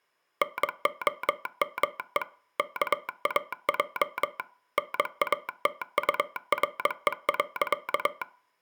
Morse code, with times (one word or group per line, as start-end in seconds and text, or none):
0.4-2.2 NOME
2.6-4.4 KAJ
4.8-8.2 NATURE.